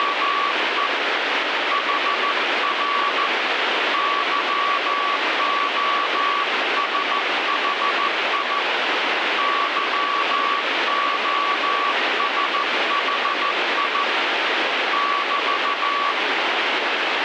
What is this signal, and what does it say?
Morse code, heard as a keyed tone, hand-sent with a paddle, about 14 wpm, 1140 Hz, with heavy radio static. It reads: … HR YOSHI YOSHI <BT>